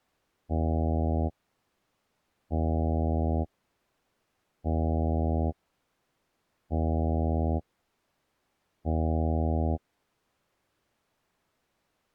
Ship horn signal, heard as a ship's horn, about 80 Hz. 5 short. At sea: I doubt that you are doing enough to avoid a collision.